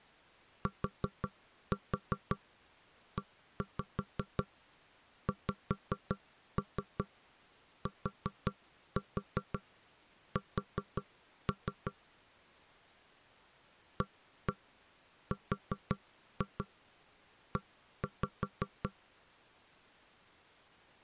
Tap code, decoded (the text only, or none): TEXTS ARE